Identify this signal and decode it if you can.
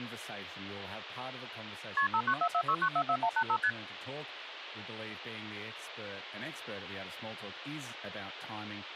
Multi-frequency trunk signalling (R1, as on North American trunks), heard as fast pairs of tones, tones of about 70 ms, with phone line noise and speech in English. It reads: KP 59446944185 ST